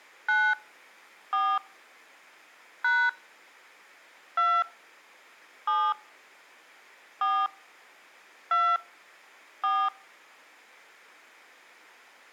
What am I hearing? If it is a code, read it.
DTMF, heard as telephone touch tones, dialled by hand, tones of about 250 ms. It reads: 9 4 # 2 7 4 2 4